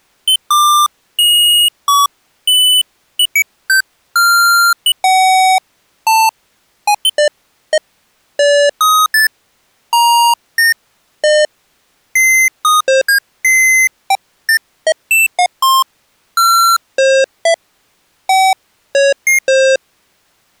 Electronic bleeps of random pitch and length. There is no code.